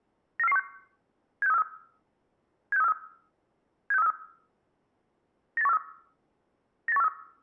Five-tone selective call (EEA), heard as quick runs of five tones, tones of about 40 ms. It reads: 94416 76343 76343 76343 98143 98143